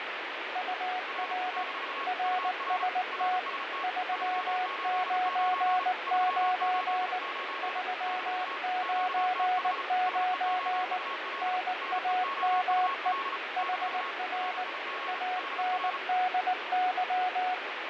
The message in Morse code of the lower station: UR RST 399 399 NAME HR ANDY

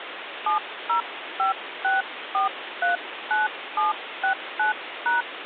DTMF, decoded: 7056439769#

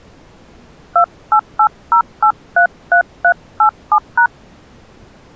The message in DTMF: 2880833387#

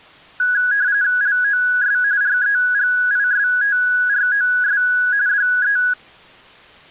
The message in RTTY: LOS REGISTROS DE

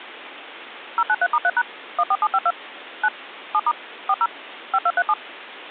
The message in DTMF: 093*3# 14752 9 7* 40 5237

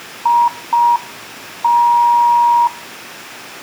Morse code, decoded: IT

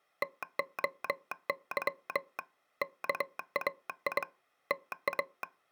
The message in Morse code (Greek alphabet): ΤΟΥ ΚΑΙ ΤΑ

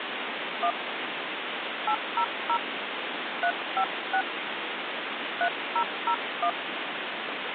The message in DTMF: 1 800 356 3001

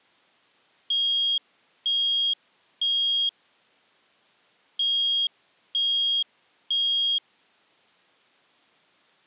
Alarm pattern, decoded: temporal three

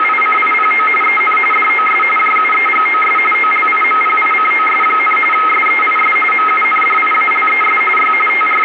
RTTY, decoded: … EN DOS JUEGOS OLIMPICOS, SEIS MUNDIALES Y …

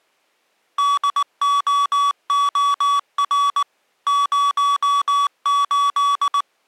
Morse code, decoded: DOOR 08

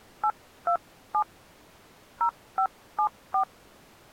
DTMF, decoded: 827 0574

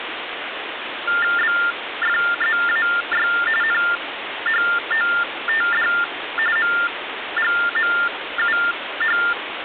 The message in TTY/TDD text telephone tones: BFZAY NHOTD MGMUH

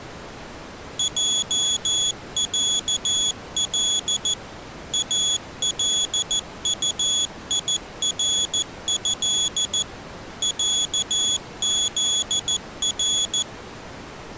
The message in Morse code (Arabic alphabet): جعل الطيره عذر

